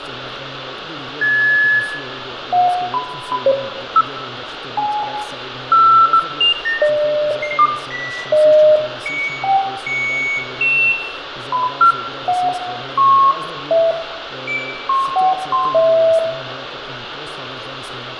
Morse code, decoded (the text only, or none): none